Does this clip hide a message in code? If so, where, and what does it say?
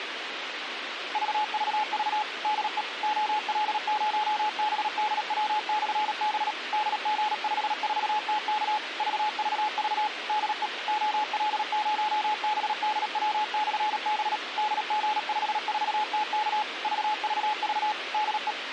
Yes: Morse code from 1.1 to 18.6 s, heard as a keyed tone, machine-sent, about 37 wpm, 850 Hz, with radio hiss and a squelch burst at the end. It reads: VVV DE OL0BDW/B DG54TK VVV DE OL0BDW/B DG54TK VVV DE